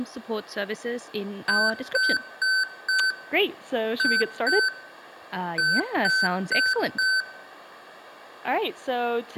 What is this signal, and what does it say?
Beep code, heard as beeps from a small speaker, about 1550 Hz, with room echo and speech in English. 4-2-4. In Phoenix BIOS tables: unexpected interrupt in protected mode.